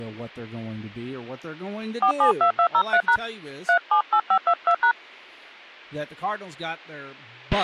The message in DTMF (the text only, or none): 472203# 378522#